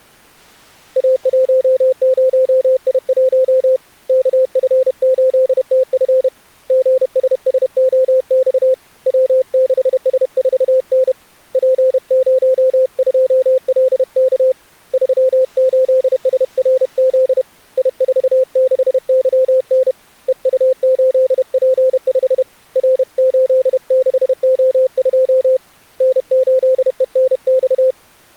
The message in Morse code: A10I1 KF8TF GSSOX W6S4N P02LK 38SRZ I46YN EU8P5 R86O2 N8ENX

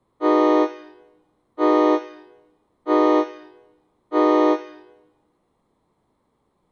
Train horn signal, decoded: 4 short

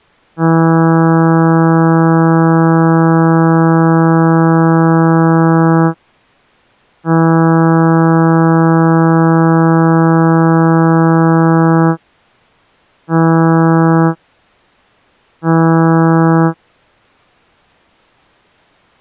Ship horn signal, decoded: 2 long, 2 short

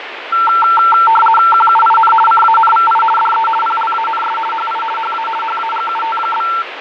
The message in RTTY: QUIN CANVI DE PLANS HI HA HAGUT?

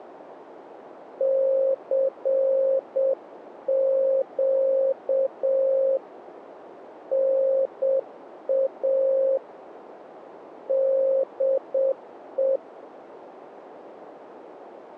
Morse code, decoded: CQ NA DE

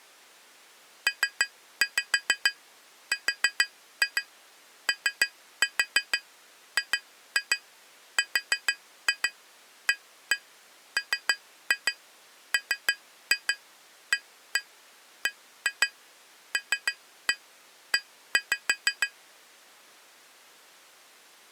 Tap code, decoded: PROGRAMMABLE

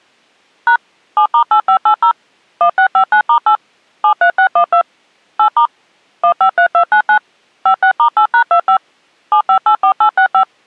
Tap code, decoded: none

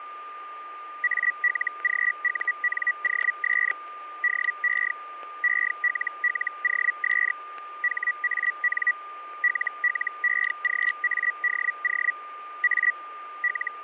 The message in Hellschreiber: ALGUNOS DE ELLOS HAN LLEGADO A …

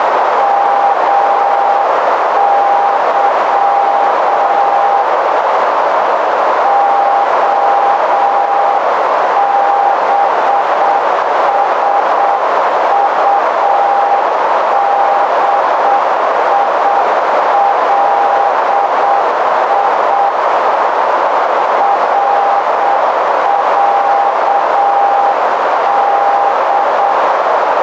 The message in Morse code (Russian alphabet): МЫ ОБСУДИЛИ РЯД

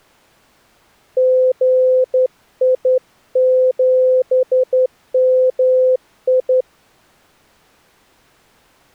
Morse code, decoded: GI7MI

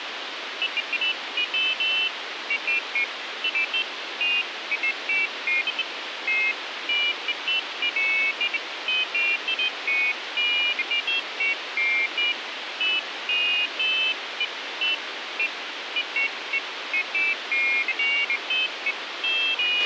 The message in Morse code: none

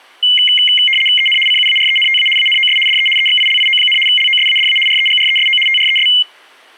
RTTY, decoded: EN CUARENTA ANOS DE EXILIO, LOSADA REGRESO TRES

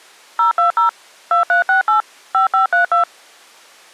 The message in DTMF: 020 2368 5532

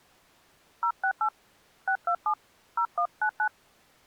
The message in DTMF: 068 627 0199

